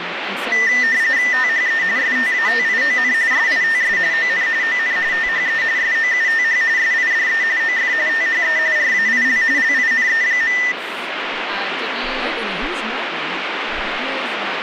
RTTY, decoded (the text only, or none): THE STATION SITS ON ON THE SOUTH SIDE OF THE RAIL LINE.